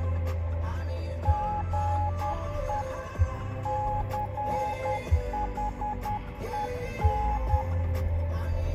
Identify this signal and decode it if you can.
Morse code, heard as a keyed tone, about 10 wpm, 840 Hz, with room echo and the noise inside a car. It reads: GE CHEN